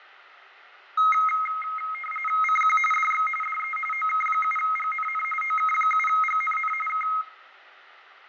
RTTY (45.45 baud, 850 Hz shift), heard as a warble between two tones, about 1700 Hz centre, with radio static, fading and room echo. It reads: CQ DX DE OK7GNN OK7GNN K